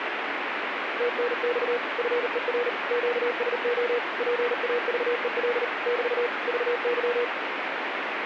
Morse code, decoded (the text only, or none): TNX FER QSO PAVEL <BT> VY